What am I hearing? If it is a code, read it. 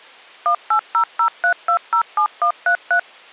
DTMF, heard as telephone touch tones, dialled by machine, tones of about 90 ms. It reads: 18003207133